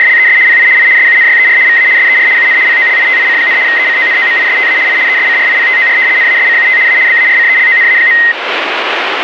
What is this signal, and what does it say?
RTTY (75 baud, 170 Hz shift), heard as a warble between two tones, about 1950 Hz centre, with radio static. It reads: … PI I SUNYER VA SER UN POLITIC, ECONOMISTA I ESCRIPTOR NASCUT A BARCELONA.